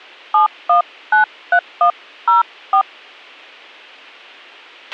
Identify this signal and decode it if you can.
DTMF, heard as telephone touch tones, dialled by hand, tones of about 110 ms, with a squelch burst at the end. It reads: 7193104